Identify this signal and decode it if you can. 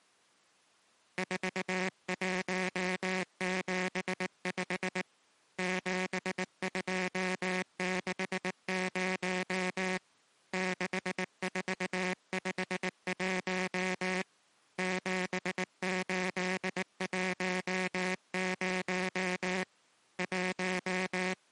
Morse code, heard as a buzzer, hand-sent with a paddle, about 19 wpm. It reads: 4175 7260 6451 7810 …